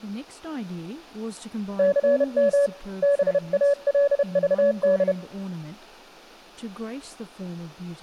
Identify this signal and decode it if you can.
Morse code (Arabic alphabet), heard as a keyed tone, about 31 wpm, 570 Hz, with speech in English. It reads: ثم بالضد